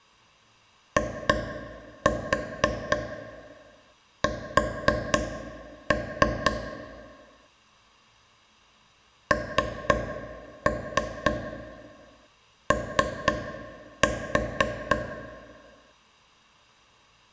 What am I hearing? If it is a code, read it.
Tap code, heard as taps on a table, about 4 knocks a second, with room echo. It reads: IS NO